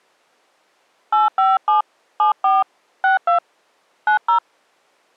DTMF, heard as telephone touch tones, dialled by hand, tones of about 160 ms. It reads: 857 74 62 90